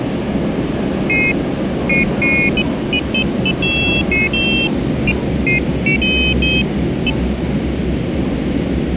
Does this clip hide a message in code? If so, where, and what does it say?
No, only pairs of high tones at irregular times, with radio hiss and the noise inside a subway train.